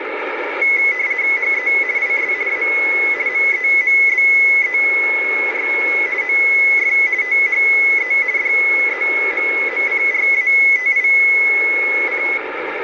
RTTY (50 baud, 170 Hz shift), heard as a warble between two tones, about 2100 Hz centre, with radio static. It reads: HE IS A MEMBER OF THE DEMOCRATIC